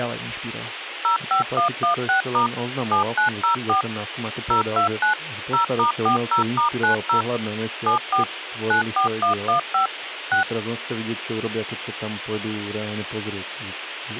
DTMF, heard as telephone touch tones, dialled by machine, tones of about 110 ms, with radio hiss, a squelch burst at the end and speech in Slovak. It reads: 05116* 7904 029 0*40*90 74 94115 6